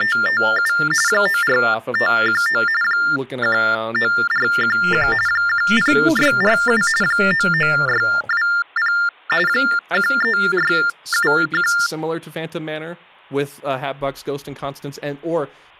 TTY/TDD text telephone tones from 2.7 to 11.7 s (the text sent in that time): 19411 10647 99620 13671